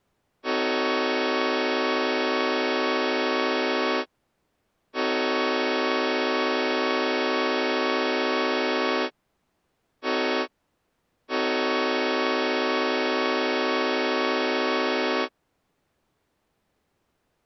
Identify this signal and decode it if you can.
Train horn signal, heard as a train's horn. 2 long, 1 short, 1 long. On North American railways: approaching a public crossing.